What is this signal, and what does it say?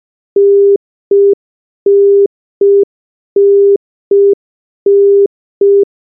Telephone call progress tone (UK plan), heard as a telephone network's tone, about 400 Hz. Congestion tone.